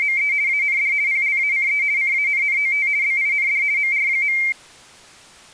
RTTY (50 baud, 170 Hz shift), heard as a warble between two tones, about 2200 Hz centre. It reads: … AND PLACE CANNOT BIND MR.